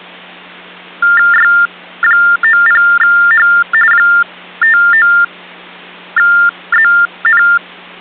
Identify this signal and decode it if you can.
TTY/TDD text telephone tones (45.45 baud Baudot), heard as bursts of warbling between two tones, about 400 Hz shift, 1600 Hz centre, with hum. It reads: Y90H 59ZN